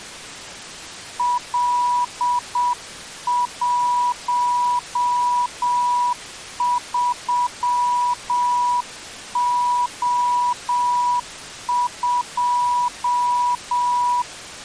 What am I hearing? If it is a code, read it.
Morse code, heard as a keyed tone, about 7 wpm, 980 Hz. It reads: L13O2